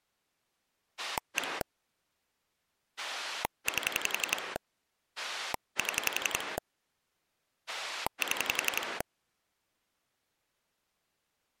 Pulse dialling, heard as a rotary dial, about 11 pulses a second. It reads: 1 8 7 7